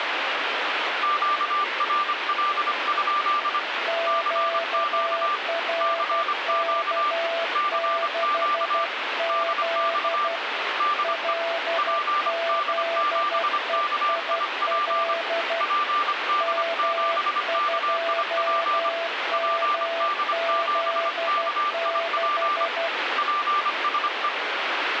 Morse code, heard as two keyed tones, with radio static. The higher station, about 25 wpm, 1180 Hz: QRL? CQ CQ CQ DX DE PD7KIP PD7KIP PD7KIP PSE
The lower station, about 12 wpm, 670 Hz: QRK6Z LZEIL M2MZ6